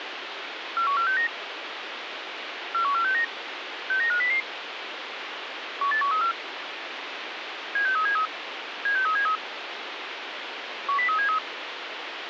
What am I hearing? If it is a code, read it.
Five-tone selective call (CCIR), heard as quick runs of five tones, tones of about 100 ms, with radio hiss. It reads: 41469 41469 69500 18134 76373 76373 10373